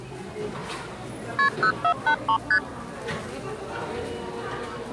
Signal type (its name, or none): multi-frequency trunk signalling